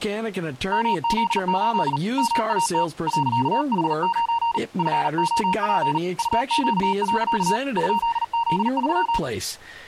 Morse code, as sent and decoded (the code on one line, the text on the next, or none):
-- --.. ---.. / -- .- - / .-.-.- .... ----. / ..-. --- .--. / ..- --.- .-.-.- / ..--.. --.. ...--
MZ8 MAT .H9 FOP UQ. ?Z3